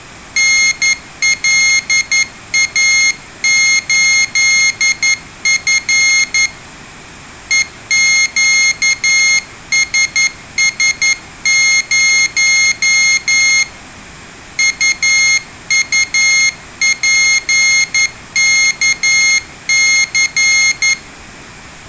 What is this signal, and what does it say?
Morse code, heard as a high beeper, hand-sent with a paddle, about 11 wpm, 2150 Hz, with room echo. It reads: NLA8F EQSS0 UUPKC